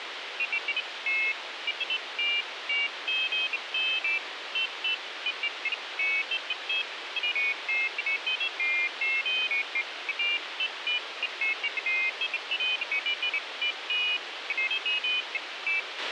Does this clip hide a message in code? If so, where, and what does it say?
No, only pairs of high tones at irregular times, with radio hiss and a squelch burst at the end.